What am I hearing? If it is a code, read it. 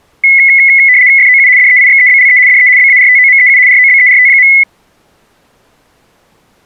RTTY (75 baud, 170 Hz shift), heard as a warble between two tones, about 2100 Hz centre. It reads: FOU DEIXEBLE DE BARTOMEU ROBERT.